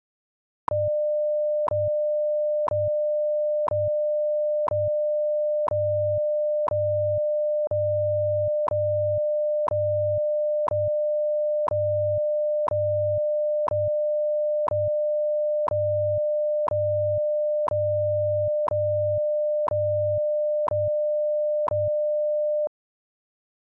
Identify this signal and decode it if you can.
Radio time signal (WWV, Colorado), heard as ticks, one a second.